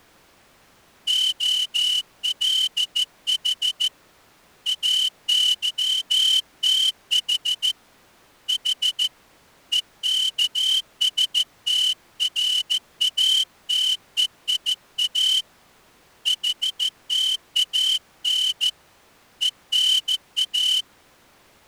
Morse code (Greek alphabet), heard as a whistle, hand-sent with a straight key, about 14 wpm. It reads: ΟΛΗ ΑΥΤΗ Η ΕΚΣΤΡΑΤΕΙΑ ΗΤΑΝ ΕΝΑ